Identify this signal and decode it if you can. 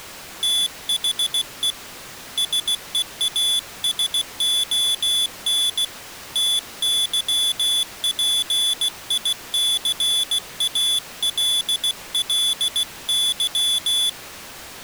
Morse code, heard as a high beeper, hand-sent with a paddle, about 16 wpm, 3450 Hz. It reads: THE SEASON TYPICALLY